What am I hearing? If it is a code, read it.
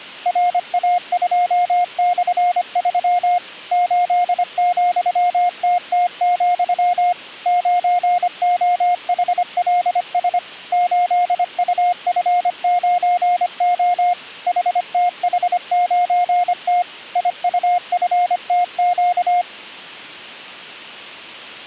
Morse code, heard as a keyed tone, machine-sent, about 25 wpm, 710 Hz. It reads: RA2/3 8,TT, 9OHLS 8UF9O HTH9T IUFTQ